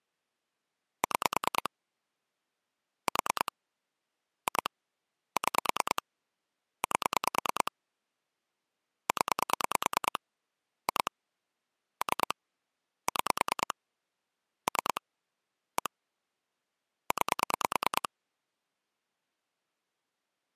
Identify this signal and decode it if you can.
Pulse dialling, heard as clicks on a phone line, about 9 pulses a second. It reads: 6 4 2 6 8 0 2 3 6 3 1 9